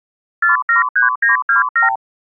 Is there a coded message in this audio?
Yes: multi-frequency trunk signalling (R2, with the far end's replies) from 0.4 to 2.0 s, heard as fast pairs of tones, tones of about 130 ms. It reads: 473927